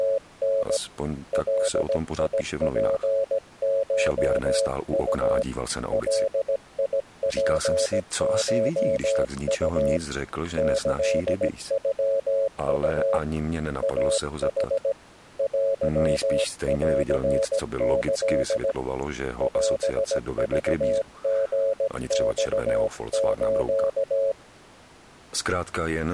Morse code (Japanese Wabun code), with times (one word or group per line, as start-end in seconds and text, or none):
0.0-0.8 …
1.3-5.4 ガツコウ
5.9-10.0 ガツコウ
10.6-13.2 キノウ
13.8-14.9 イヌ
15.4-18.7 テンキ
19.4-24.3 オクリマス